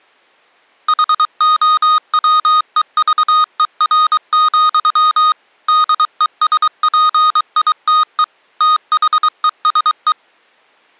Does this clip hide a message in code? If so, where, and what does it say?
Yes: Morse code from 0.8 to 10.2 s, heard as electronic beeps, machine-sent, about 23 wpm, 1240 Hz. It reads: HOWEVER, DESPITE THESE